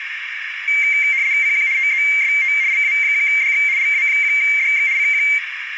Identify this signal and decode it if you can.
RTTY (75 baud, 170 Hz shift), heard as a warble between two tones, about 2200 Hz centre, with radio static and a narrow filter. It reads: CQ TEST LA1DX LA1DX CQ